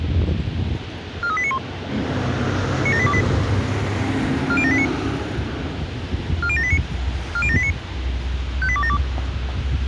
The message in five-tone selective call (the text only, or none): 43891 97828 40789 40789 40789 58272